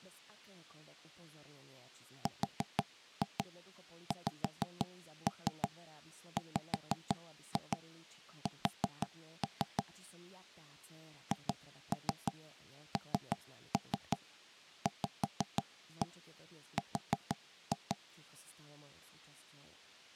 Tap code, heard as knocks on wood, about 6 knocks a second, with speech in Slovak. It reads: RXWS HNVR